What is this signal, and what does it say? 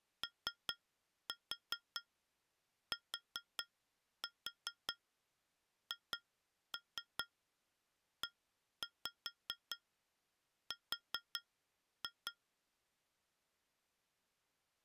Tap code, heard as taps on glass, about 4 knocks a second. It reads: OTHER